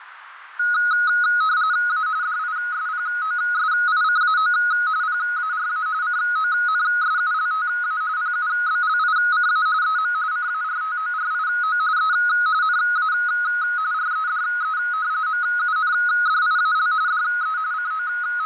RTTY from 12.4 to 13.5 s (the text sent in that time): NA